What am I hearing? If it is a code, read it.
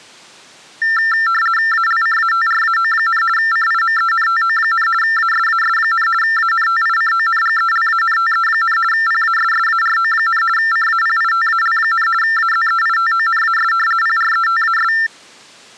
RTTY (50 baud, 450 Hz shift), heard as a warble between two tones, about 1600 Hz centre. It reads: ALCATRAO, CIMENTO, ASAS, ANTICONGELANTE, PASSARO, CAPITAL, AZEITONAS PRETAS